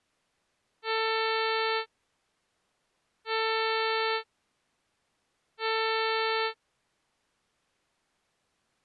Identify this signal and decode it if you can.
Ship horn signal, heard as a ship's horn, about 440 Hz. 3 short. At sea: I am operating astern propulsion.